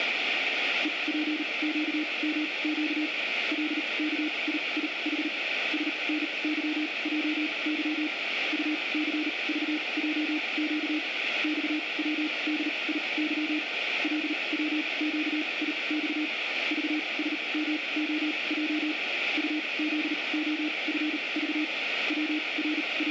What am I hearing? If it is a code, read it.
Morse code, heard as a keyed tone, machine-sent, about 38 wpm, spaced as for 27 wpm, 300 Hz, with radio static. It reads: EPQMQ LKIIH SNYJY UCVJQ XWDIY LWQIX VSMOJ UZOFV …